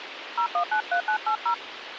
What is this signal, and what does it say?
DTMF, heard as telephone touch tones, dialled by hand, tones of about 90 ms, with radio hiss. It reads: 0193980